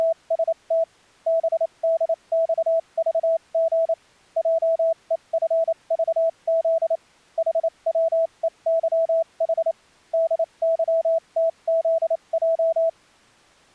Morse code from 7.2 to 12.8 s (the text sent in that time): HWEYH DYTZJ